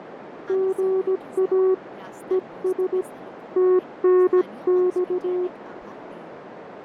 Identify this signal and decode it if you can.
Morse code, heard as a keyed tone, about 17 wpm, 370 Hz, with radio static, fading, a narrow filter and speech in Assamese. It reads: GA ES TNX